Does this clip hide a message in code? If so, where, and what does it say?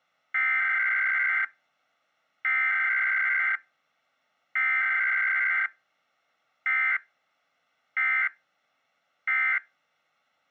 Yes: Emergency Alert System (SAME) tones (header bursts, then end-of-message bursts) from 0.3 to 9.6 s, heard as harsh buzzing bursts, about 520.83 baud.